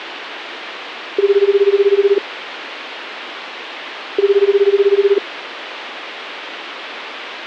Telephone call progress tone (Japanese plan), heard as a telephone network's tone, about 380, 400, 420 Hz, 1 s on and 2 s off, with phone line noise. Ringback tone.